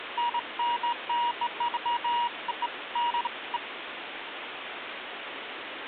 Beeps of irregular length, with phone line noise. There is no code.